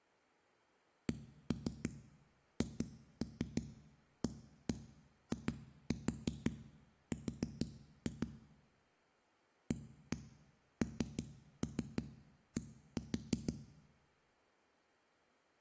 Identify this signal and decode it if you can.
Tap code, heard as knocks on a wall, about 6 knocks a second, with room echo. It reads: CHAIR AND